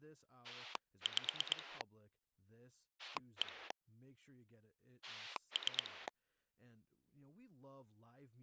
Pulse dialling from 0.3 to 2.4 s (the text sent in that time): 5